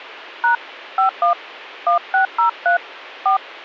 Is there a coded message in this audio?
Yes: DTMF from 0.4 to 3.4 s, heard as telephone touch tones, dialled by hand, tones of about 110 ms. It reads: # 51 1603 4